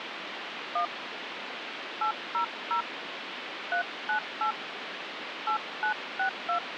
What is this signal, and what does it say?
DTMF, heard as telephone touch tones, dialled by hand, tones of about 100 ms, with phone line noise. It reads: 1 800 398 8962